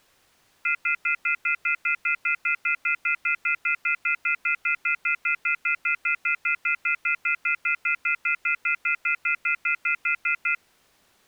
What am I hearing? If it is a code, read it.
Telephone call progress tone (North American plan), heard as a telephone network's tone, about 1400, 2050, 2450, 2600 Hz, 0.1 s on and 0.1 s off. Off-hook warning tone.